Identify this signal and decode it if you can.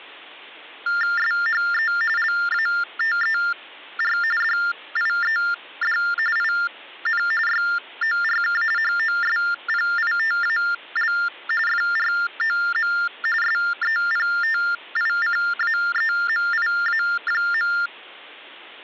TTY/TDD text telephone tones (45.45 baud Baudot), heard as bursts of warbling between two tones, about 400 Hz shift, 1600 Hz centre. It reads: SHE LATER DIED IN YORK HOSPITAL FROM SEPTICAEMIA.